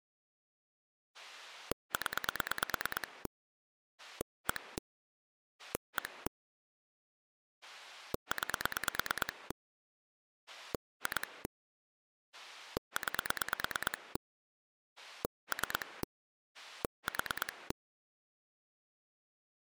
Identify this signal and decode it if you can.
Pulse dialling, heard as a rotary dial, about 9 pulses a second. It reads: 0 1 1 9 2 9 3 4